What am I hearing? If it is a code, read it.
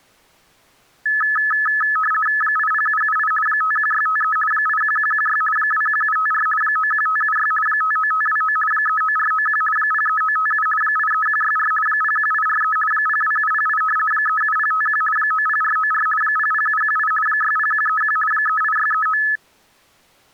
RTTY (50 baud, 450 Hz shift), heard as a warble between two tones, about 1500 Hz centre. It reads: 80778 51653 81116 21754 91576 59529 39491 03957 83164 01843 02708 37051 90494 00718 60131 38639